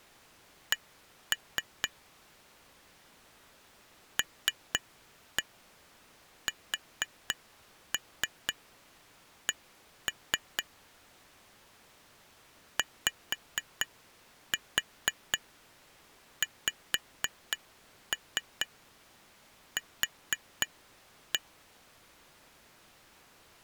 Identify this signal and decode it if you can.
Tap code, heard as taps on glass, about 4 knocks a second. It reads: C LSC YXQ